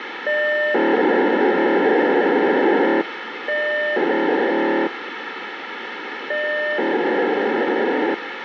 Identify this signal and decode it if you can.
POCSAG pager data (1200 baud), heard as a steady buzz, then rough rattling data, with radio hiss.